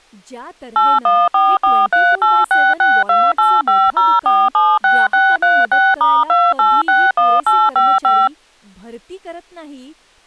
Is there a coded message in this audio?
Yes: DTMF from 0.8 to 8.3 s, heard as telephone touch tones, dialled by machine, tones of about 230 ms, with speech in Marathi. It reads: 814438662850476636*2861855